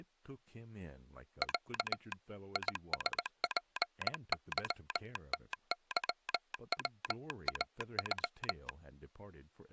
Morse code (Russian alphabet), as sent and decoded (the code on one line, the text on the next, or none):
.-.- / .. ... .--. -.-- - -.-- .-- .- ..--
Я ИСПЫТЫВАЮ